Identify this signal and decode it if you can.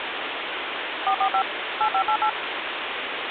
DTMF, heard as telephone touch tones, dialled by machine, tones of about 80 ms, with phone line noise. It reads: 445 8588